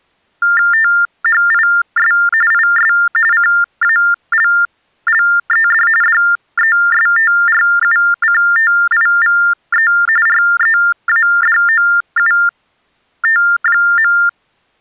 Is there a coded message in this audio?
Yes: TTY/TDD text telephone tones (45.45 baud Baudot) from 0.4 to 14.3 s, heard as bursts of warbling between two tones, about 400 Hz shift, 1600 Hz centre. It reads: THIS IS CALLED DESTRUCTIVE READOUT.